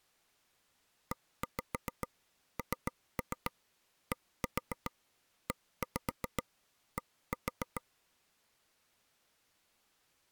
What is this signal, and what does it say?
Tap code, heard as taps on a table, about 7 knocks a second. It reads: ENDED